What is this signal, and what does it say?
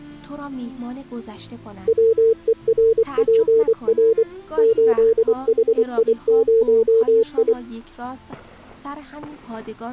Morse code, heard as a keyed tone, machine-sent, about 24 wpm, 450 Hz. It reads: WERPR 8HI0I